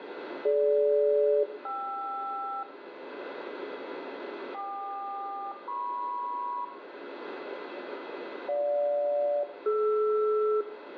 Aircraft SELCAL, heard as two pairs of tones, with radio static, a steady whistle near 2020 Hz and room echo. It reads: DG-KR KQ-MP GJ-DR